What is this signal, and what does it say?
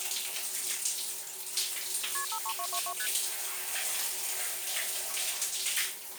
Multi-frequency trunk signalling (R1, as on North American trunks), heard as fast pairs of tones, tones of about 70 ms, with the noise of a restroom. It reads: KP 53222 ST